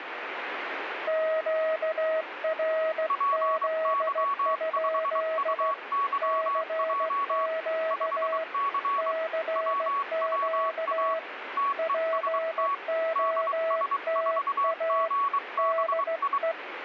Morse code, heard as two keyed tones, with radio static. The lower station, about 16 wpm, 650 Hz: QRZ? CQ CQ POTA DE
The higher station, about 23 wpm, 1120 Hz: PY5UYJ 5C WWA TEST DS4GBI